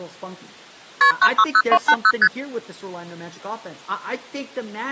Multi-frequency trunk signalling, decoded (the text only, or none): KP 960280 ST